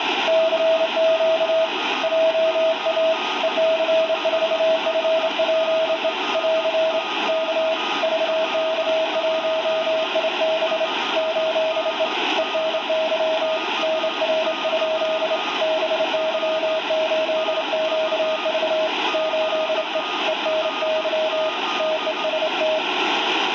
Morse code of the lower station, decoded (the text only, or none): CQ JA EC4FPE <AR> K VK1IB 8E ENY NR? BY8QV 8E ENY TEST